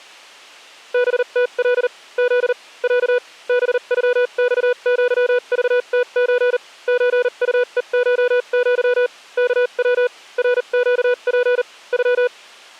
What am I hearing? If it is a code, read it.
Morse code (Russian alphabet), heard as a keyed tone, machine-sent, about 39 wpm, spaced as for 33 wpm, 490 Hz. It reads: БТЛ З Я БЮЬЪЖТЧ ЧУЕШЪ КВ РЩП Ю